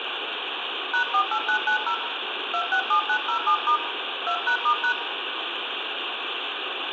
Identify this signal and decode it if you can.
DTMF, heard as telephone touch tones, dialled by hand, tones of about 80 ms, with phone line noise and room echo. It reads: #48990 267907* 2#*#